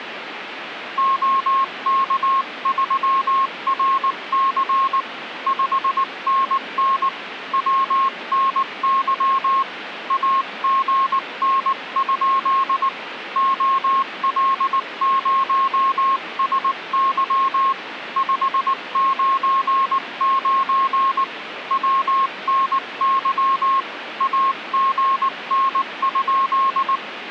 Morse code, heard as a keyed tone, hand-sent with a paddle, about 19 wpm, 1080 Hz, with radio static. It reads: OK3RC 5NN WNY AGN? OL0SY 599 WNY AGN?